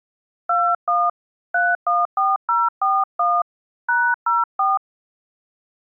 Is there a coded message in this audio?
Yes: DTMF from 0.5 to 4.8 s, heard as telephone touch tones, dialled by hand, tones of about 220 ms. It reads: 21 314041 #04